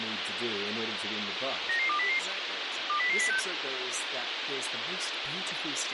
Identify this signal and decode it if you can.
Five-tone selective call (CCIR), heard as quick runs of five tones, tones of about 100 ms, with radio hiss and speech in English. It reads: 99200 20006